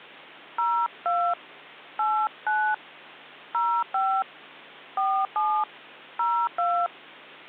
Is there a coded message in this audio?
Yes: DTMF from 0.6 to 6.9 s, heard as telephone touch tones, dialled by hand, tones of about 280 ms, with hum. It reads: 02 89 05 47 02